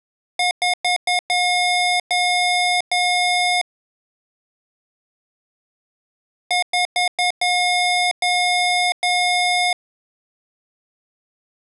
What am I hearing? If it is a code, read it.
Beep code, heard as beeps from a small speaker, played twice, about 720 Hz. 4 short, 3 long.